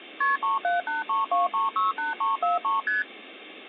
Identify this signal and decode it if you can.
Multi-frequency trunk signalling (R1, as on North American trunks), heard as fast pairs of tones, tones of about 150 ms. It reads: KP 37832368343 ST